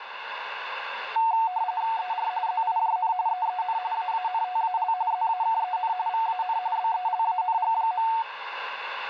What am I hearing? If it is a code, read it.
RTTY (45.45 baud, 170 Hz shift), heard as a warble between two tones, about 820 Hz centre, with radio static. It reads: ER ZIJN EEN AANTAL ZAKEN VAN BELANG.